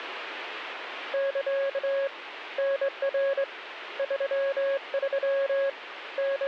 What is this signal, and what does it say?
Morse code, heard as a keyed tone, hand-sent with a straight key, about 22 wpm, 550 Hz, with radio static. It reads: <KA> NR 33 …